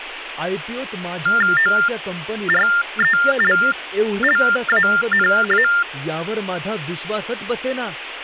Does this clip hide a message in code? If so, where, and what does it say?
Yes: TTY/TDD text telephone tones (45.45 baud Baudot) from 1.3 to 5.8 s, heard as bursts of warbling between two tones, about 400 Hz shift, 1600 Hz centre, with phone line noise and speech in Marathi. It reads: ORELLANA